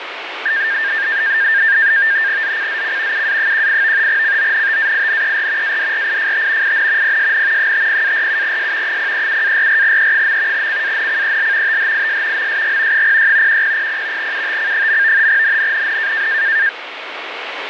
NAVTEX (SITOR-B), 100 baud, 170 Hz shift, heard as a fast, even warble, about 1700 Hz centre, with radio static. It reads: ZCZC UA18 CONTAINER ADRIFT IN PSN 50-47S 037-44E. CANCEL THIS MSG 06 1000 UTC. NNNN